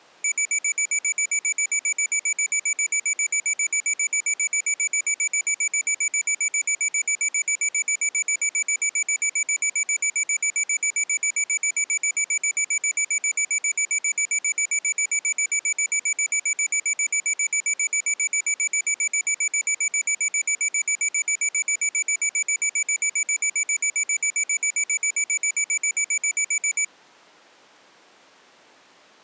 Evenly repeated beeps. There is no code.